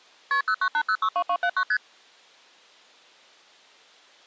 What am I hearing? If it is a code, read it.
Multi-frequency trunk signalling (R1, as on North American trunks), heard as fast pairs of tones, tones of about 70 ms. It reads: KP 098062279 ST